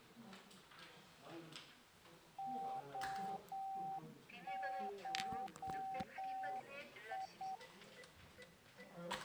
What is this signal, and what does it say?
Morse code (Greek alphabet), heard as a keyed tone, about 8 wpm, 770 Hz, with the noise of a crowd indoors. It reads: ΟΧΙ